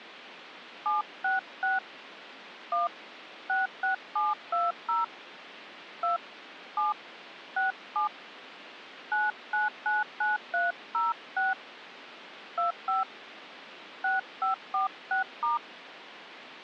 DTMF, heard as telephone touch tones, dialled by hand, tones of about 150 ms. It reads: 766 1 66720 2 7 67 9999306 25 6546*